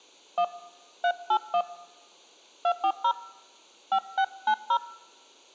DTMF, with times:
0.4-0.4 1
1.0-1.6 381
2.6-3.1 240
3.9-4.8 5690

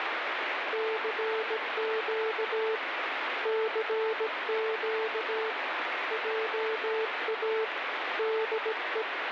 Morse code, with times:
0.7-2.8 CQ
3.5-5.5 CQ
6.1-7.6 JA
8.2-9.0 DE

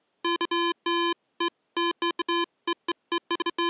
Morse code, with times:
none

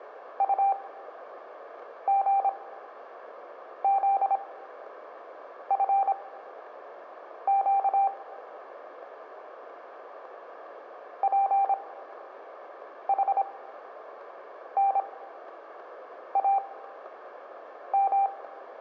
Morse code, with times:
0.4-8.1 UGZFQ
11.2-18.3 PHNAM

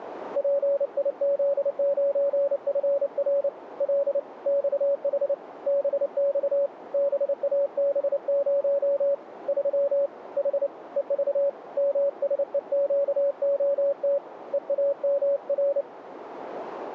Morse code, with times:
0.4-3.5 PIZ9FR
3.8-4.2 L
4.5-5.3 XH
5.7-6.7 BX
6.9-9.1 BAB0
9.5-10.1 3
10.4-10.7 H
11.0-11.5 EV
11.8-14.2 MSEQOT
14.5-15.8 EAMR

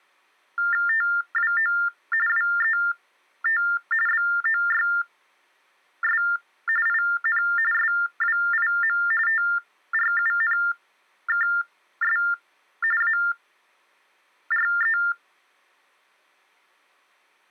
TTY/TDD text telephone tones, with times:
0.9-1.7 TWO
2.3-3.6 WET
4.1-6.2 BOYS
6.9-7.4 IN
7.7-9.0 SWIM
9.3-12.2 TRUNKS
13.0-15.0 ARE

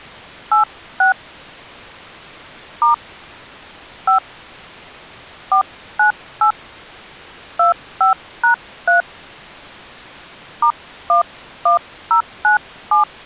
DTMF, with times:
0.5-1.1 86
2.8-2.9 *
4.1-4.2 5
5.5-6.5 498
7.6-9.0 25#3
10.6-13.0 *11097

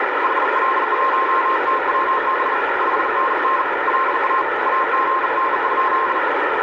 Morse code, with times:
0.2-2.5 HL1TWB
2.8-3.6 5NN
3.9-4.4 LA
4.7-6.2 AGN?

